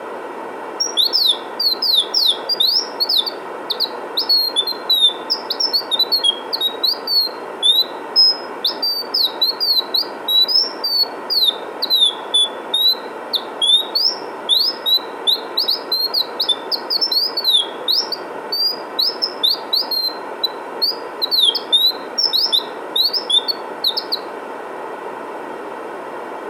Bird-like chirps, with room echo. There is no code.